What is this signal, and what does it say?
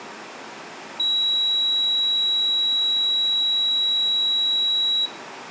A steady tone. There is no code.